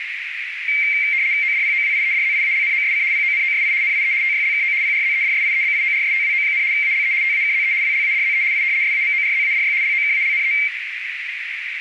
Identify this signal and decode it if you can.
RTTY (75 baud, 170 Hz shift), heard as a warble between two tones, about 2200 Hz centre, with radio static and a narrow filter. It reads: ODPOWIEDZIALNOSC PONOSI NIE TYLKO PRZEDSIEBIORSTWO, ALE TAKZE WLADZE I SAMORZADY LOKALNE